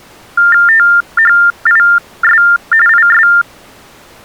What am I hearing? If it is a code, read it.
TTY/TDD text telephone tones (45.45 baud Baudot), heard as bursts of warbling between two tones, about 400 Hz shift, 1600 Hz centre. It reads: THIS IS